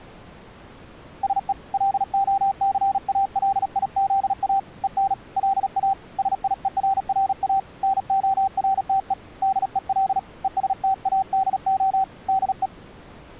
Morse code, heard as a keyed tone, hand-sent with a paddle, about 37 wpm, 780 Hz. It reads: SE LOCALIZA EN LA SIERRA NORTE DEL ESTADO DE